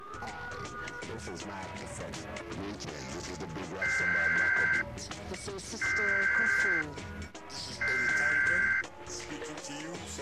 Emergency Alert System (SAME) tones (header bursts), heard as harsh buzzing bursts, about 520.83 baud.